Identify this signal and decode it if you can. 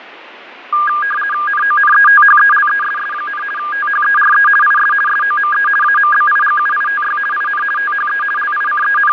RTTY (50 baud, 450 Hz shift), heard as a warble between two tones, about 1420 Hz centre, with radio static and fading. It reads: NONETHELESS, THERE IS SOME AMBIGUITY IN THE …